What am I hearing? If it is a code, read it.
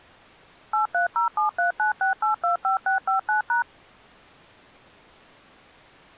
DTMF, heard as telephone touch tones, dialled by machine, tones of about 120 ms. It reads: 8307396825659#